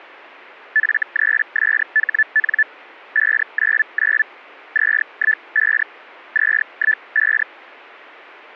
Hellschreiber (Feld-Hell, 122.5 baud), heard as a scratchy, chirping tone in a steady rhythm, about 1750 Hz. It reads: F3SHN 599 215 215